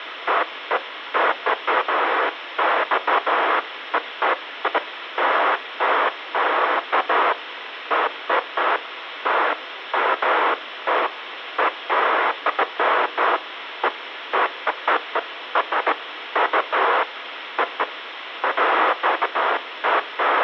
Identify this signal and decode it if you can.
Bursts of noise, with phone line noise. There is no code.